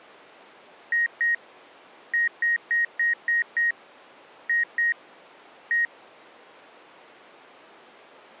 Beep code, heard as beeps from a small speaker, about 1900 Hz. 2-6-2-1.